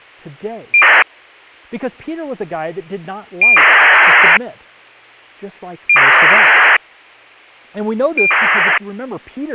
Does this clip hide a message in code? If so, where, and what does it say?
Yes: ACARS aircraft data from 0.7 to 8.8 s, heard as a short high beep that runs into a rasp, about 2400 baud, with speech in English.